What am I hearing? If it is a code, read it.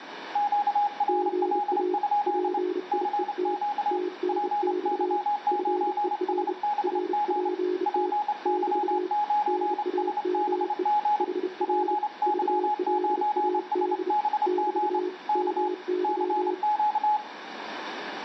Morse code, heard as two keyed tones, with radio static and room echo. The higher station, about 27 wpm, 840 Hz: QRL? CQ PY9SBG PY9SBG PY9SBG K CQ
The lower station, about 31 wpm, 360 Hz: GA PIET TNX FER RPT <BT> NAME HR VLAD <BT> MY